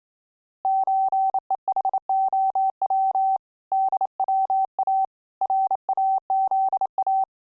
Morse code (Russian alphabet), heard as a keyed tone, hand-sent with a bug key, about 28 wpm, 770 Hz. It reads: ЧЕХОВ ДВА РАЗА